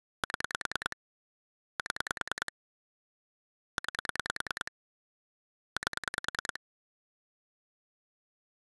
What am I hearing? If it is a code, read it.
Pulse dialling, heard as clicks on a phone line, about 10 pulses a second. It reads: 7 7 9 8